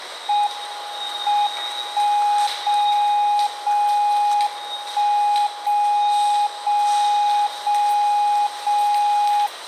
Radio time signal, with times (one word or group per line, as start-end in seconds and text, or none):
0.5-1.5 M
1.5-2.5 1
2.5-3.5 0
3.5-4.5 0
4.5-5.5 1
5.5-6.5 0
6.5-7.5 0
7.5-8.5 0
8.5-9.5 0